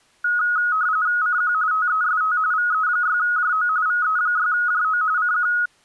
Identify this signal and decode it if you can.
RTTY (45.45 baud, 170 Hz shift), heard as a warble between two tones, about 1360 Hz centre. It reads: CQ TEST VE6JO VE6JO CQ